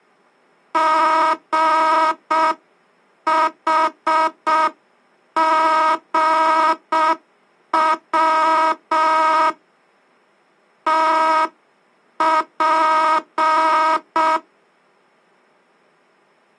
Morse code, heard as a buzzer, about 6 wpm. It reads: GHGW TP